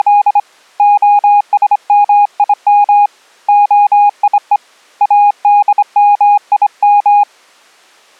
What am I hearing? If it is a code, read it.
Morse code (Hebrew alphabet), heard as a keyed tone, hand-sent with a straight key, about 25 wpm, 820 Hz. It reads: … השמים היו אדמים